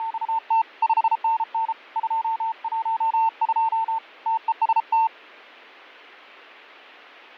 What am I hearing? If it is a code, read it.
Morse code, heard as a keyed tone, hand-sent with a bug key, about 33 wpm, 900 Hz, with fading. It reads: … 5NN 212 TEST